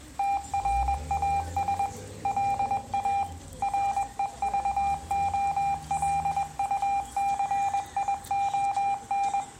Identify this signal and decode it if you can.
Morse code, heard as electronic beeps, machine-sent, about 21 wpm, 800 Hz, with room echo and street noise. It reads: TRAS LA REVOLUCION